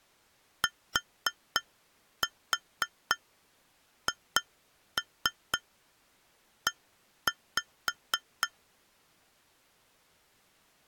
Tap code, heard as taps on glass, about 4 knocks a second. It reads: THE